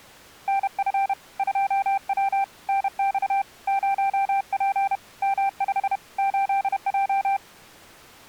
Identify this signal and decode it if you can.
Morse code, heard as a keyed tone, hand-sent with a paddle, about 31 wpm, 790 Hz. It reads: NF 2W NX 0P M5 8J